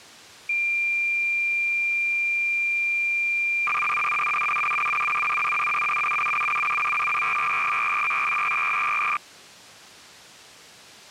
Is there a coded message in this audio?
Yes: cassette data (Kansas City type), 300 baud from 0.5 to 9.2 s, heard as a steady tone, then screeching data.